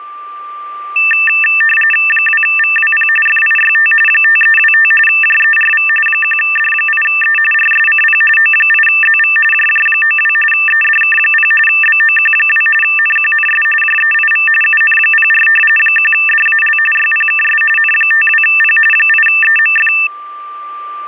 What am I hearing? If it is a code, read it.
RTTY (45.45 baud, 850 Hz shift), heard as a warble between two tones, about 2200 Hz centre, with a steady whistle near 1180 Hz. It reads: 2VWP FIYT 5325 JERV 1D8E RSCP O8ZV JJ92 EDK0 BOQ2 NQNS JEIV UN04 1DAL YPKS N52P 8EMF